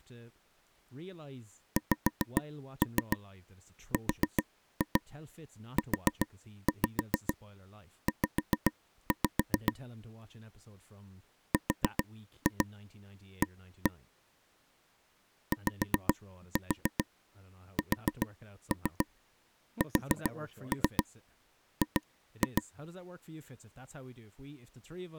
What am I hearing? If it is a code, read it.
Tap code, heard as taps on a table, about 7 knocks a second, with speech in English. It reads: XRUZ RA YSSG